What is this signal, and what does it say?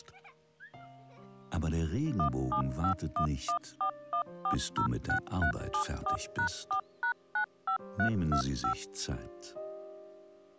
DTMF, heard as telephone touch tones, dialled by machine, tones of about 90 ms. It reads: 1751141406374#4#95325